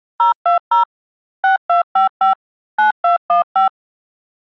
DTMF, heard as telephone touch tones, dialled by machine, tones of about 120 ms. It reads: 020 6255 9215